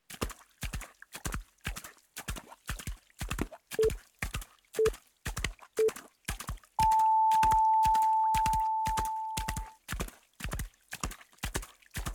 Radio time signal (three low pips and a long one an octave up, as on NHK), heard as pips.